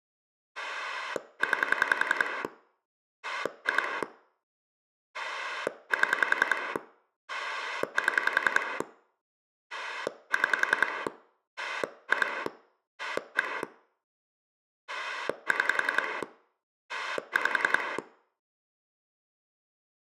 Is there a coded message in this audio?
Yes: pulse dialling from 0.6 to 18.0 s, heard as a rotary dial, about 10 pulses a second, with room echo. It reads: 9 2 7 7 6 2 1 6 5